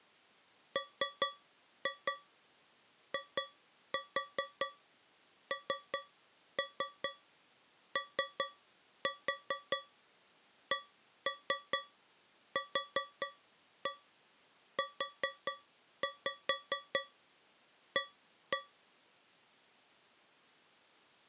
Tap code, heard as taps on a metal pipe, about 4 knocks a second. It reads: MINOCQUA